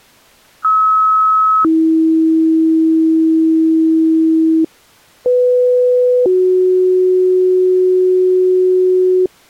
Two-tone page, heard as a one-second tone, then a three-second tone, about 1290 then 320 Hz, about 500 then 370 Hz.